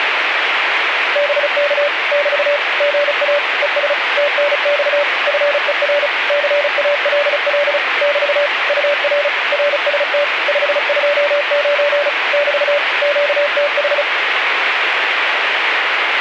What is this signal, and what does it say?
Morse code, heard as a keyed tone, machine-sent, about 35 wpm, 580 Hz, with radio static. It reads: BK <BT> GA ES TNX FER CALL <BT> UR RST 529 <BT> QTH